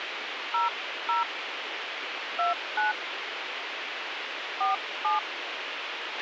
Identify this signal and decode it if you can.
DTMF, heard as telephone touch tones, dialled by hand, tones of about 150 ms, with radio hiss and a squelch burst at the end. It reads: 00 29 47